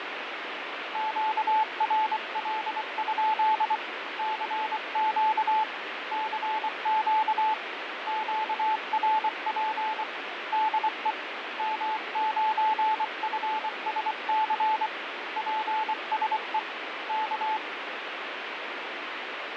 Morse code, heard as a keyed tone, hand-sent with a paddle, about 24 wpm, 870 Hz, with radio static. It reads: QRL? CQ CQ QRP DE M9FSC PSE K